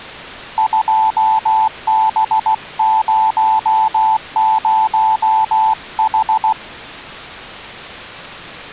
Morse code, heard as a keyed tone, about 16 wpm, 880 Hz. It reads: 2B00H